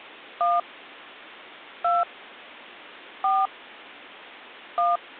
DTMF, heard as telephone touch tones, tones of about 160 ms. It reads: 1 2 4 1